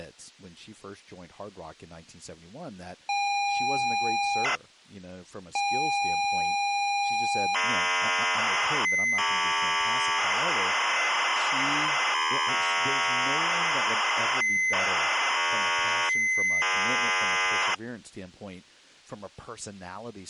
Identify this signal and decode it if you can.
ZX Spectrum tape loading, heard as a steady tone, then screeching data, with speech in English.